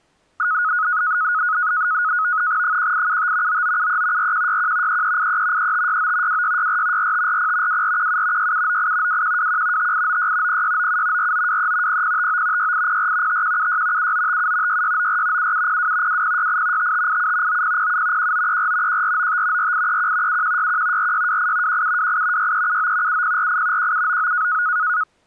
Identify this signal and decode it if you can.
NAVTEX (SITOR-B), 100 baud, 170 Hz shift, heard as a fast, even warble, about 1360 Hz centre. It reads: 1875 9973 4161 3383 3569 2664 4540 2417 6798 2121 5896 0697 4923 0059 6804 5176 7957 6694 7702 2068 5587 9007 1934 1495 4831 7161 4628 1728 6379 7048 1799